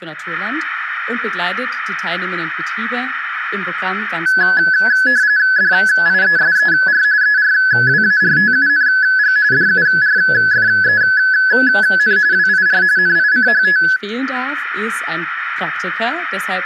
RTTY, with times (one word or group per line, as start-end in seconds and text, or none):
5.6-7.0 DIESER
7.2-9.4 ERWARTUNG
9.5-12.2 DURFEN
12.3-12.8 WIR
13.0-13.8 NICHT